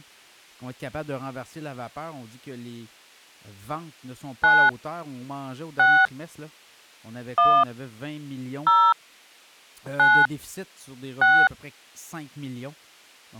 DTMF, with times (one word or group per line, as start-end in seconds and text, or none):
4.4-4.7 9
5.8-6.1 6
7.4-7.6 1
8.7-8.9 0
10.0-10.3 9
11.2-11.5 6